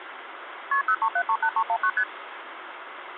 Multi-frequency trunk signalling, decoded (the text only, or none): KP 03738319 ST